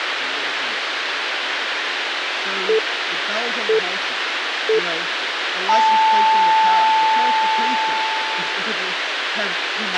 Radio time signal (three low pips and a long one an octave up, as on NHK), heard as pips, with radio hiss and a squelch burst at the end.